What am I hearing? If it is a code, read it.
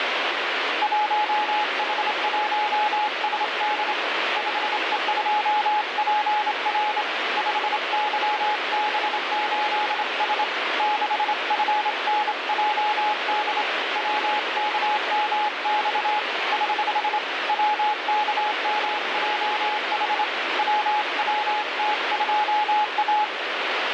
Morse code, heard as a keyed tone, hand-sent with a straight key, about 27 wpm, 840 Hz, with heavy radio static. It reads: 1H1SD 5E2PR 5YB8S 6FNJD WKMX <HH> WKMJH WWT2A